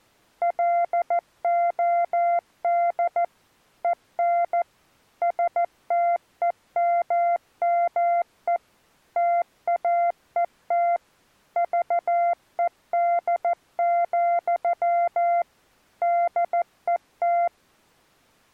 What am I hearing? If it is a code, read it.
Morse code, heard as a keyed tone, machine-sent, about 14 wpm, 690 Hz. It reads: LOD EN STEMME TAET VED, DET